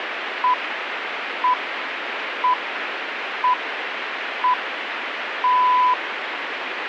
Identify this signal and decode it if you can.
Radio time signal (six pips, as the Greenwich Time Signal), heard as pips, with radio static.